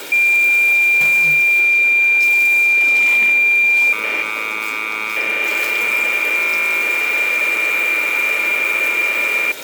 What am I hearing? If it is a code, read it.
Cassette data (Kansas City type), 1200 baud, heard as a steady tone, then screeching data, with tape hiss and the noise of a restroom.